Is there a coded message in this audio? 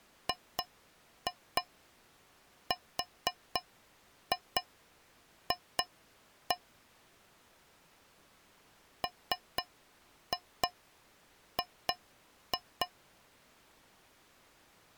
Yes: tap code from 0.3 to 12.9 s, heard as taps on a metal pipe, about 4 knocks a second. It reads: GRF MG